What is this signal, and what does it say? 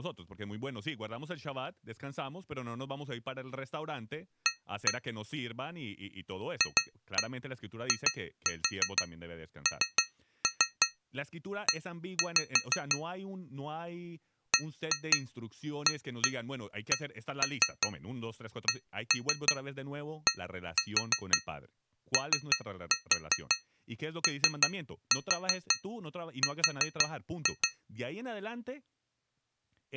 Tap code, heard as taps on glass, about 5 knocks a second, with speech in Spanish. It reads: A FINE BACKDOOR